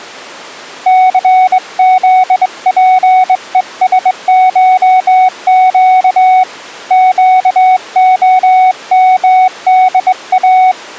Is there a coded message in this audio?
Yes: Morse code (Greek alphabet) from 0.8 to 10.8 s, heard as a keyed tone, hand-sent with a straight key, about 22 wpm, 740 Hz. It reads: ΘΖΠΕΣΧΨ ΨΟΜΔΑ